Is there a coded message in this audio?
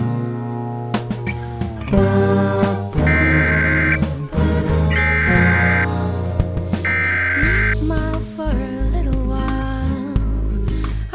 Yes: Emergency Alert System (SAME) tones (header bursts) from 3.1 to 7.7 s, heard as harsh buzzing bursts, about 520.83 baud.